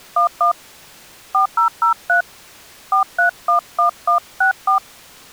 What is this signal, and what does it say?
DTMF, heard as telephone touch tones, dialled by hand, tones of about 110 ms. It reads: 11 4003 4311164